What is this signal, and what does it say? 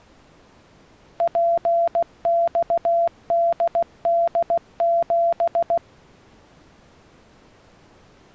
Morse code, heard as a keyed tone, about 16 wpm, 680 Hz. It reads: PXDD7